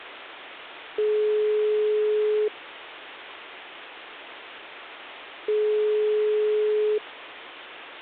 Telephone call progress tone (single-tone plan, as in most of Europe), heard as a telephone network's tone, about 420 Hz, 1.5 s on and 3 s off. Ringback tone.